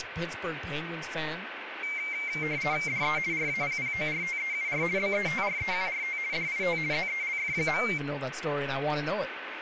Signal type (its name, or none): RTTY